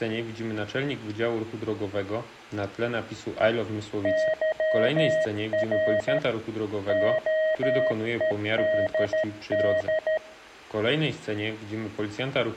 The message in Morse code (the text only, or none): YR OEDD